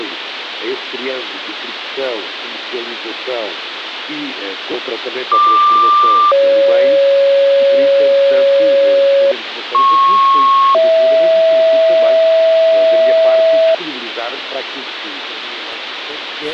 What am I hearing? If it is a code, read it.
Two-tone page, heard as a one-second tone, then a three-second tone, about 1180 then 550 Hz, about 1090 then 650 Hz, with radio hiss.